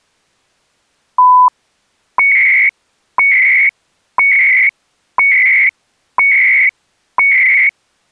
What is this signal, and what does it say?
Radio time signal (CHU, Canada), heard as beeps and data bursts, one a second.